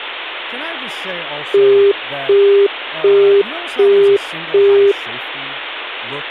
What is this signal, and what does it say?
Telephone call progress tone (as in the UK, Australia and similar networks), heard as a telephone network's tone, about 400 Hz, 0.375 s on and 0.375 s off, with speech in English. Busy tone.